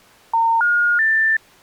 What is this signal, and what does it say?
Telephone call progress tone (North American plan), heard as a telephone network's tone, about 910, 1430, 1800 Hz. Special information tone.